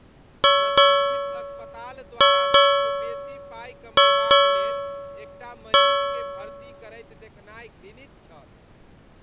Ship's bell, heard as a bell, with speech in Maithili. 7. Seven half-hours of the watch have passed.